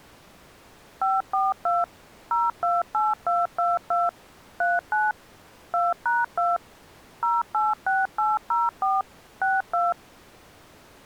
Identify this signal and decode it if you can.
DTMF, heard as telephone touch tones, dialled by machine, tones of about 190 ms. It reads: 542 028222 39 2#2 086804 62